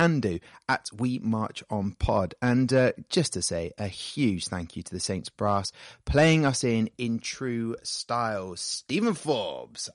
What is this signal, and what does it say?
Speech in English. There is no code.